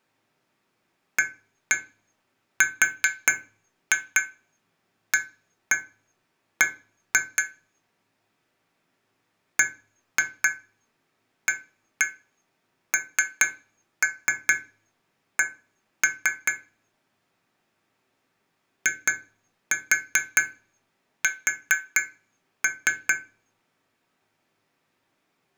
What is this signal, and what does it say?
Tap code, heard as taps on glass, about 4 knocks a second. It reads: ARAB BANK IS